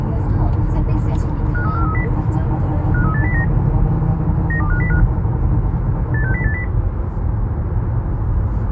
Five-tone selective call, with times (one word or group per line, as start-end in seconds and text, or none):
1.5-2.0 53430
2.9-3.4 53809
4.5-5.0 92505
6.1-6.6 86080